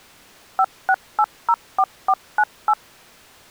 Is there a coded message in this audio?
Yes: DTMF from 0.6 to 2.7 s, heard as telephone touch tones, dialled by machine, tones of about 60 ms. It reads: 56804498